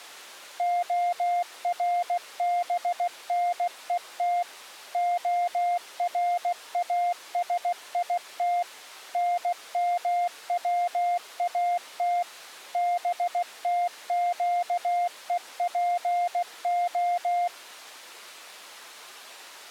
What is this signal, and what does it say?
Morse code (Hebrew alphabet), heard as a keyed tone, machine-sent, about 16 wpm, 700 Hz. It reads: הרבנות הראשית נמצאת בתקופה